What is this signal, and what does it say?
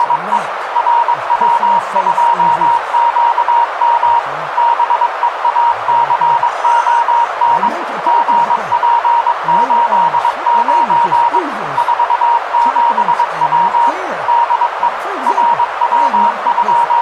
Morse code, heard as a keyed tone, machine-sent, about 22 wpm, 940 Hz, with radio static and a narrow filter. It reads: … RW2QM BEACON GP89 47W DE …